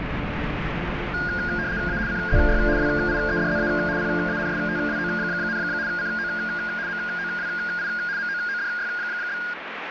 RTTY (75 baud, 170 Hz shift), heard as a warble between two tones, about 1550 Hz centre, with radio static. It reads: A CZY WIEDZA PANSTWO, CO MOWI MOODY?